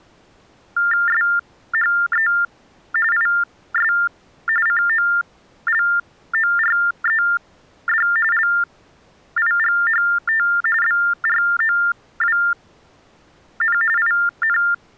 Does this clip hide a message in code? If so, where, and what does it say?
Yes: TTY/TDD text telephone tones (45.45 baud Baudot) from 0.8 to 14.7 s, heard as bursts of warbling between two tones, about 400 Hz shift, 1600 Hz centre. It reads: SHE IS COLORED LIGHT BROWN IN